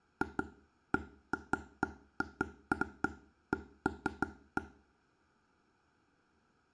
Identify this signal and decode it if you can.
Irregular taps on a table, with room echo. There is no code.